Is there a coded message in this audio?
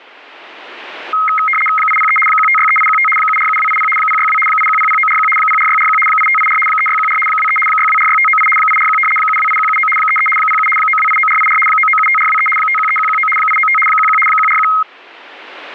Yes: RTTY (75 baud, 850 Hz shift) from 1.1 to 14.8 s, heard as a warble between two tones, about 1700 Hz centre. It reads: 803 1563815 747280 062 8100941 04641 8584 3614 23 6246598 841 728179 33 07 9289484 9975423 513119 895 11 141